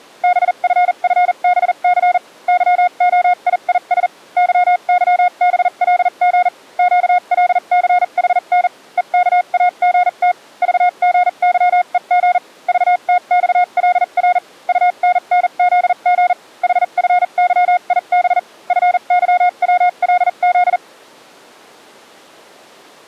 Morse code, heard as a keyed tone, machine-sent, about 40 wpm, spaced as for 34 wpm, 720 Hz. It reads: BFFBC YOIIS YYBLG QLCHN EKAGT VGYEG VTXLR UNNZG HFYIB FYWLZ